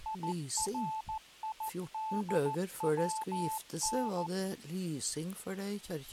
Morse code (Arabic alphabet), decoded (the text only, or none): يريدون